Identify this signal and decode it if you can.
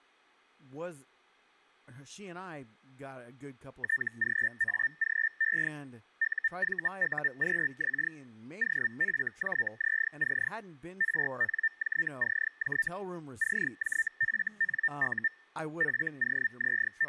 Hellschreiber (Feld-Hell, 122.5 baud), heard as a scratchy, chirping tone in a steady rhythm, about 1800 Hz, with speech in English. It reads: TGAGE UVUQX OFJZC RNJCJ CJFNU …